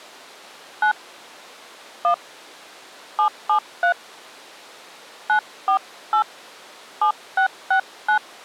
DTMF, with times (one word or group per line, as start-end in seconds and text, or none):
0.8-0.9 9
2.0-2.1 1
3.2-3.9 773
5.3-6.2 948
7.0-8.2 7669